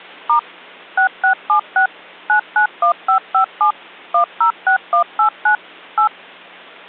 DTMF, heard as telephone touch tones, dialled by machine, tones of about 100 ms. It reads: * 6676 991557 106189 8